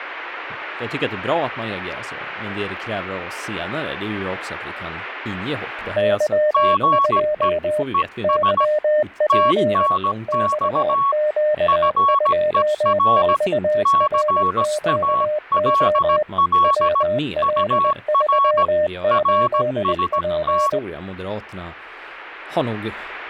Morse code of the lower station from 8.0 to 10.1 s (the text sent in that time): YP